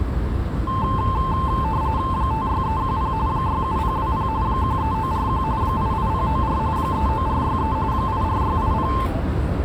RTTY (45.45 baud, 170 Hz shift), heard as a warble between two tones, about 970 Hz centre, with the noise of a residential street. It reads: 56310 67020 13941 88094 39463 84680